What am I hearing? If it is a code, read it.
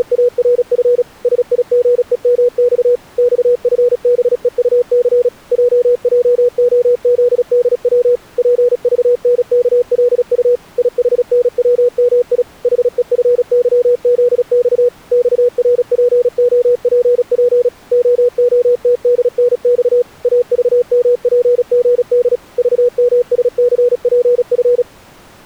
Morse code, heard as a keyed tone, machine-sent, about 36 wpm, 490 Hz. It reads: … SIGEMX XFBEUC JJOZDW PVNKLU IHNWMI HEFYZX XRPOPP OOTDNX AVMPGD VMSCPF